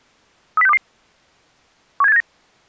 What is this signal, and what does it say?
Five-tone selective call (EEA), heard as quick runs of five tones, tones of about 40 ms. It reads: 30622 17879